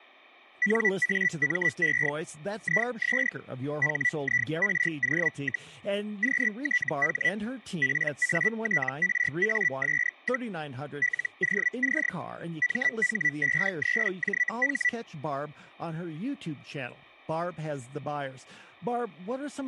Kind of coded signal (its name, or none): Hellschreiber